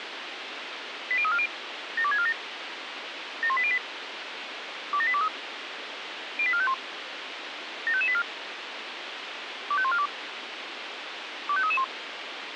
Five-tone selective call (ZVEI), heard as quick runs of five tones, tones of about 70 ms, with radio hiss. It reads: 80340 72647 71808 27823 08451 75584 25142 25331